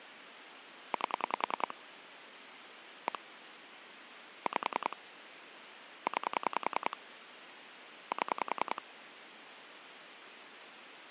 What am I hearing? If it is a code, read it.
Pulse dialling, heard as clicks on a phone line, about 10 pulses a second, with phone line noise. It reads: 8 1 5 9 7